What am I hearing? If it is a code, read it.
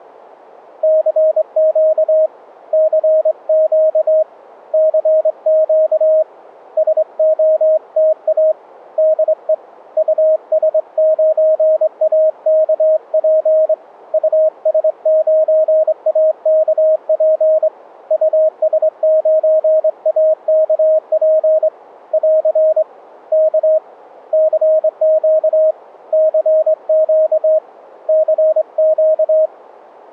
Morse code, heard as a keyed tone, hand-sent with a straight key, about 23 wpm, 630 Hz. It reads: CQ CQ CQ SOTA DE US9AKP US9AKP US9AKP <AR> K CQ CQ CQ